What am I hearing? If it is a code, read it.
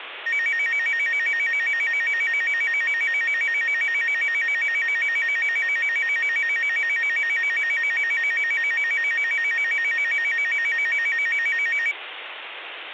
A tone that alternates evenly between two pitches, with phone line noise. There is no code.